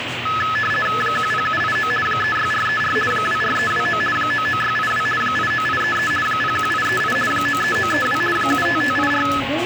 RTTY (50 baud, 450 Hz shift), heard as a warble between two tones, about 1500 Hz centre, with radio static and the noise of a restaurant. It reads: 10789 36434 24329 99682 89833 01838 93932 75584